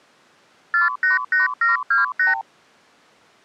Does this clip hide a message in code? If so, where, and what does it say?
Yes: multi-frequency trunk signalling (R2, with the far end's replies) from 0.7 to 2.4 s, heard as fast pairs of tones, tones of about 150 ms. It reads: 488728